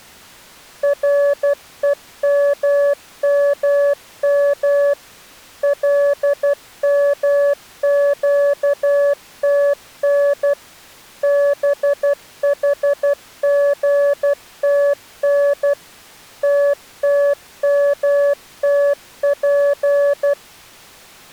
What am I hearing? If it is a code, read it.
Morse code (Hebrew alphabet), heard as a keyed tone, machine-sent, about 12 wpm, 570 Hz. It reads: רוממם למקתן בחגתן תתמתף